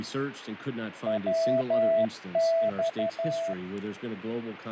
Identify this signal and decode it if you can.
Morse code, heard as a keyed tone, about 12 wpm, 660 Hz, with radio static and fading. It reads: WX